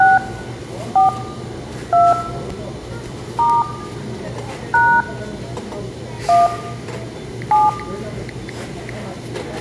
DTMF, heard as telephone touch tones, dialled by hand, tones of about 200 ms, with room echo and the noise of a crowd indoors. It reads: 6 4 2 * # 1 7